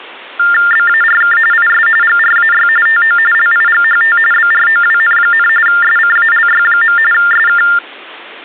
TTY/TDD text telephone tones (45.45 baud Baudot), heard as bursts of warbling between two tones, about 400 Hz shift, 1600 Hz centre. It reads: BARK IS GRAY TO LIGHT BROWN, SCALY. SK